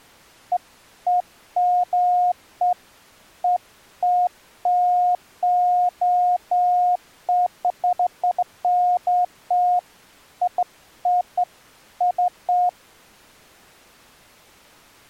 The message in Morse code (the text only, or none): none